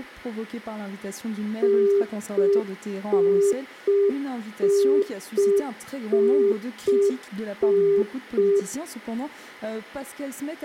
Telephone call progress tone (UK plan), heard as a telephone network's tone, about 400 Hz. Congestion tone.